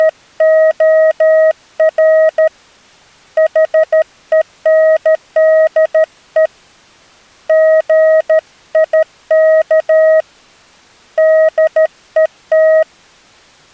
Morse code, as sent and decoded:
… / .... . -. -.. . / --. .. -.- / -.. . -
… HENDE GIK DET

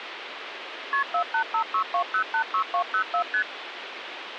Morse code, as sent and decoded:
none

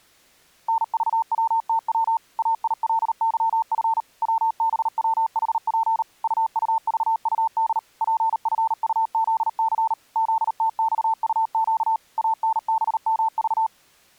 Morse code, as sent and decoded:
-. ...- .-- - .-- / .- .. .-.. -.-- ..-. / .-- -... .-- .... .--. / ..- ..- ...- ..- -.. / .--. ..-. ..- --.. -.-. / --.. - -..- ..- --.- / .- -. -... -- ...-
NVWTW AILYF WBWHP UUVUD PFUZC ZTXUQ ANBMV

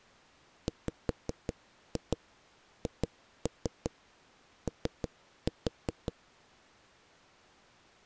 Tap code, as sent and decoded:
5-2 2-3 3-4
WHO

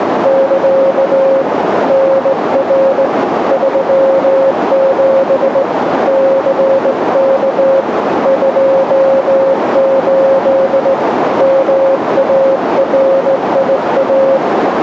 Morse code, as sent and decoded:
-.-.- / -. .-. / ...-- --... / -.-. -.- / ..--- ---.. / -- .- .-. .. .-
<KA> NR 37 CK 28 MARIA

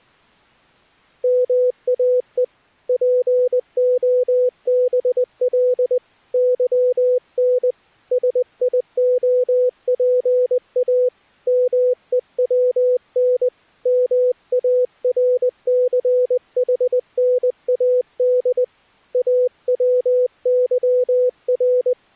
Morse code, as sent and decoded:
-- .- . / .--. --- -... .-.. / -.-- -. / ... .. --- .--. .- / -- . .-- -. / -- .- .-. -.-. .... -. .- -.. / .- .-- -.-- .-.
MAE POBL YN SIOPA MEWN MARCHNAD AWYR

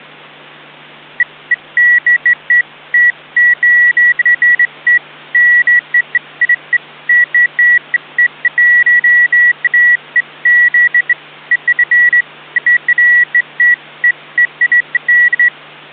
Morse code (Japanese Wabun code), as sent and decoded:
none

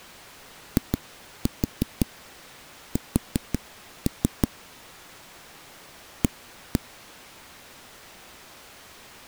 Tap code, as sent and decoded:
2-4 4-3 / 1-1
IS A

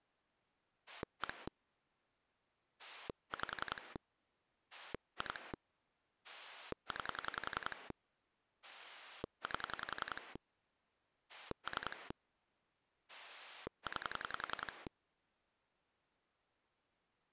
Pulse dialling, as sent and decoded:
1 / 5 / 2 / 9 / 8 / 3 / 9
1 5 2 9 8 3 9

